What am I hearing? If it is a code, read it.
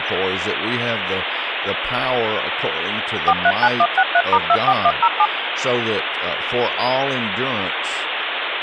DTMF, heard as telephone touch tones, dialled by machine, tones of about 60 ms, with phone line noise and speech in English. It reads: 439163*24107